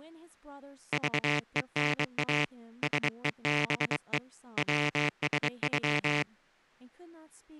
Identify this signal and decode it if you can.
Morse code (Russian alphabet), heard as a buzzer, hand-sent with a bug key, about 23 wpm, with speech in English. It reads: ЖЕНА СЕБЕ ВСЮ